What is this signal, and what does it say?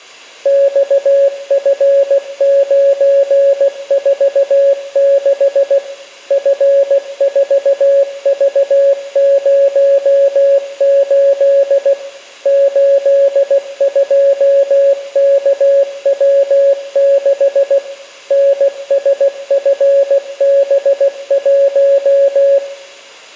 Morse code, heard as a keyed tone, machine-sent, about 16 wpm, 560 Hz, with room echo. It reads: XF946 F4V08 82KW6 NSFB1